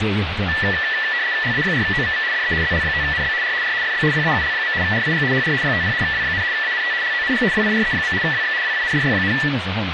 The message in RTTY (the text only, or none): LA4OVV DE ZL5NB R R FB PAUL. RIG HR 50 W, ANT LONG WIRE. WX WINDY,